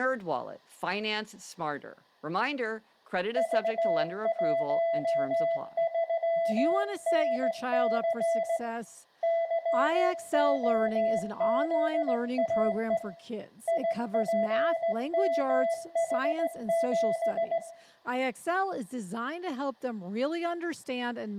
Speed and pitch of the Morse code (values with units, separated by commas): 17 wpm, 670 Hz